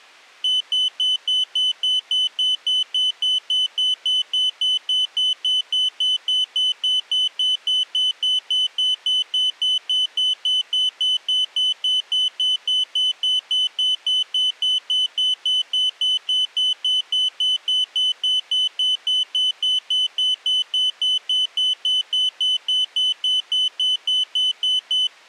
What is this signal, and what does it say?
Evenly repeated beeps. There is no code.